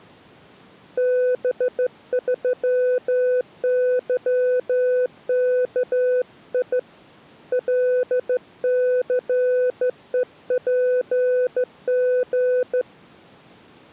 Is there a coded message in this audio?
Yes: Morse code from 0.9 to 12.9 s, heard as a keyed tone, hand-sent with a straight key, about 14 wpm, 500 Hz. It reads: B3YKI LCEPG